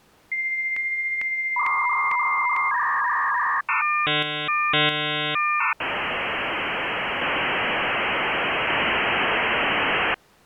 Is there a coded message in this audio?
Yes: dial-up modem handshake (V.34 or later) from 0.3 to 10.1 s, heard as a whistle, warbles, then hiss.